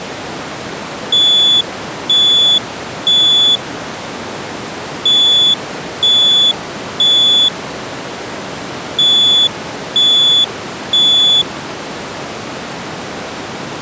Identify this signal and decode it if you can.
Alarm pattern, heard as an alarm's beeps, played three times, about 3450 Hz. Temporal three. Smoke or fire, evacuate.